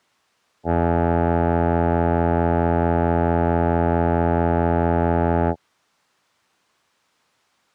Ship horn signal, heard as a ship's horn, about 80 Hz. 1 long. At sea: a vessel nearing a blind bend, or under power and making way in fog.